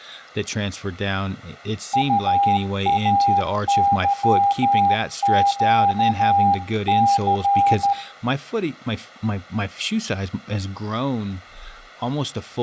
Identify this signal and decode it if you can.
Morse code, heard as a keyed tone, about 13 wpm, 800 Hz, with room echo and speech in English. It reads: UAYQC